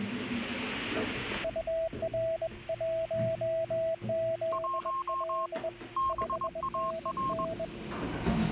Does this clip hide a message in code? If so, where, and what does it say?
Yes: Morse code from 1.4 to 7.7 s, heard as two keyed tones, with the noise inside a lift. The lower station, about 21 wpm, 650 Hz: UR1ZL 5NN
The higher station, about 21 wpm, 1070 Hz: 1 BAR